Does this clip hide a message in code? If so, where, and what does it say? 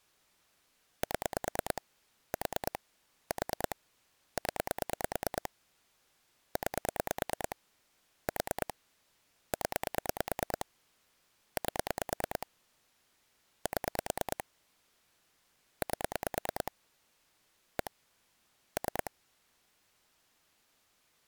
Yes: pulse dialling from 1.0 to 19.1 s, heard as clicks on a phone line, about 9 pulses a second. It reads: 7 4 4 0 9 4 0 8 7 8 1 3